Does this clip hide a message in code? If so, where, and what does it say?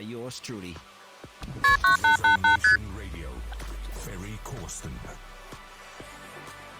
Yes: multi-frequency trunk signalling (R1, as on North American trunks) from 1.6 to 2.8 s, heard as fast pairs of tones, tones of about 120 ms. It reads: KP 9888 ST